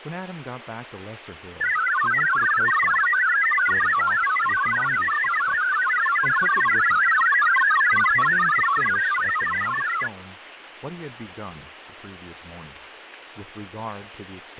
Multi-tone FSK (Olivia or MFSK type), about 1000 Hz wide, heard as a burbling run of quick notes, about 62.5 baud, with radio static, fading and speech in English.